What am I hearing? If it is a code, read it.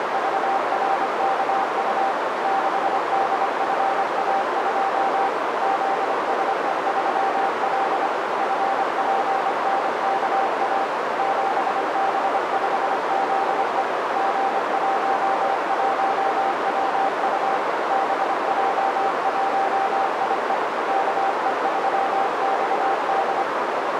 Morse code, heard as a keyed tone, machine-sent, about 25 wpm, 780 Hz, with heavy radio static and a narrow filter. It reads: … 6DFA2 ZSE3L FPNKA 7B5ZE G11WU BJ1IE KE3XD